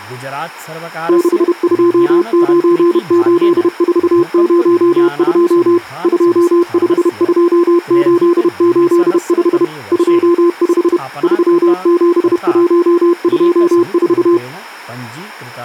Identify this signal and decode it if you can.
Morse code, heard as a keyed tone, machine-sent, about 31 wpm, 340 Hz, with speech in Sanskrit. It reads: 6298402 252885 25 37124